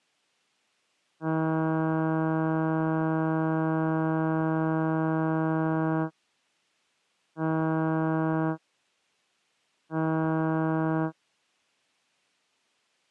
Ship horn signal, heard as a ship's horn, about 160 Hz. 1 long, 2 short. At sea: a vessel in fog that is sailing, fishing, towing or hampered.